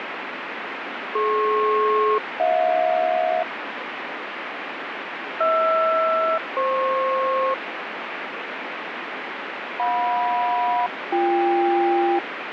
Aircraft SELCAL, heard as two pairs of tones, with radio static. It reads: DP-HJ HR-FP JM-BK